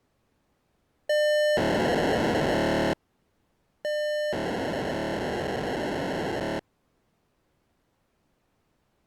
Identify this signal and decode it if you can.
POCSAG pager data (1200 baud), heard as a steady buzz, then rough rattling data.